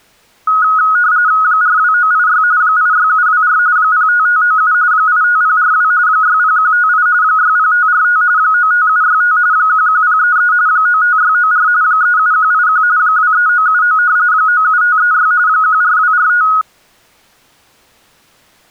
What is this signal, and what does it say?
RTTY (45.45 baud, 170 Hz shift), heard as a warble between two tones, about 1360 Hz centre. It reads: 42986 86724 05597 85042 60158 60545 95765 11033 95694 37181 23979 97536 14245